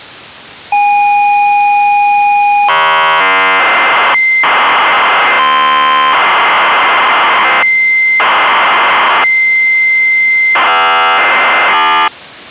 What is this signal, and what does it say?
ZX Spectrum tape loading, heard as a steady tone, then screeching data.